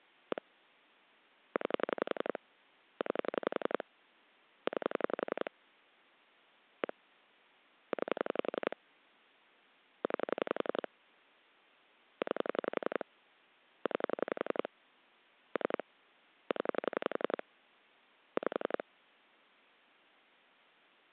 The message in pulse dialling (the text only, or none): 1 9 9 9 1 9 9 9 9 3 0 5